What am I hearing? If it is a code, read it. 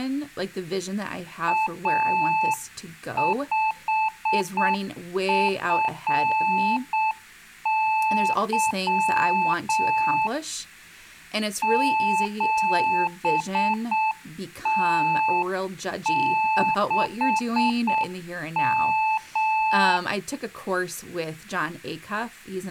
Morse code, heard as a keyed tone, hand-sent with a straight key, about 7 wpm, 870 Hz, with speech in English. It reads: A5FY 7T6M